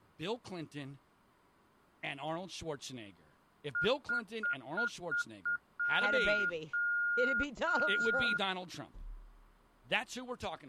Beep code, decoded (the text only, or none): 6 short, 3 long